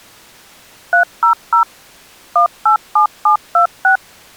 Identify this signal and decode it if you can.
DTMF, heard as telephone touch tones, dialled by machine, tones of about 110 ms. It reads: 300 187726